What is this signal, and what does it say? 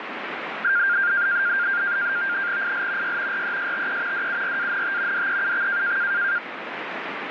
NAVTEX (SITOR-B), 100 baud, 170 Hz shift, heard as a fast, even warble, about 1500 Hz centre, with radio static. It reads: IL Y RESTE DURANT DEUX